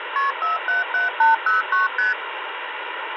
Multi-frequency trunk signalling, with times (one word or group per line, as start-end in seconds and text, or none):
0.2-0.3 KP
0.4-1.9 477809
2.0-2.1 ST